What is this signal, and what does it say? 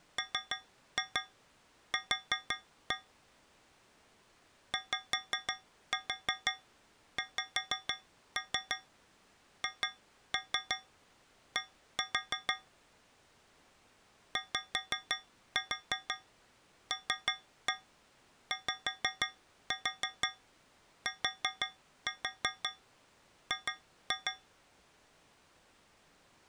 Tap code, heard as taps on a metal pipe, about 6 knocks a second. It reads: MQ YXHD YLYTG